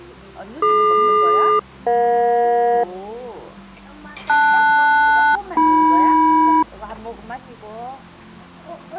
Aircraft SELCAL, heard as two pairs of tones, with the noise of a restaurant. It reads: DQ-EJ LS-AM